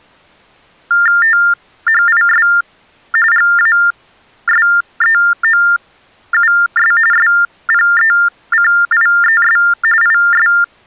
TTY/TDD text telephone tones (45.45 baud Baudot), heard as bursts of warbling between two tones, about 400 Hz shift, 1600 Hz centre. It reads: THIS GASEOUS SPECIES IS